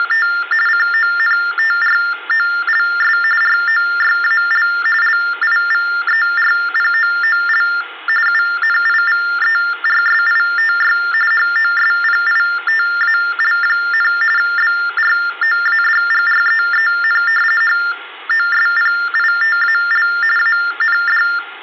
TTY/TDD text telephone tones (45.45 baud Baudot), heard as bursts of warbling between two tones, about 400 Hz shift, 1600 Hz centre. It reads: … CONTROLS ROYAL LIVERPOOL UNIVERSITY HOSPITAL, BROADGREEN HOSPITAL AND